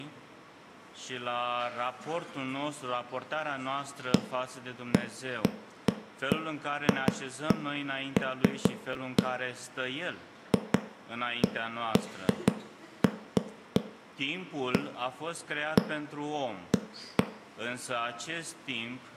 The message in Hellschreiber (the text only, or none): none